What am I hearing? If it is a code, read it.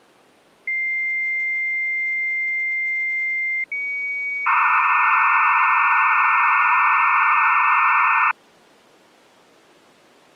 Dial-up modem handshake (low-speed, two carriers), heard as two whistles, then hiss.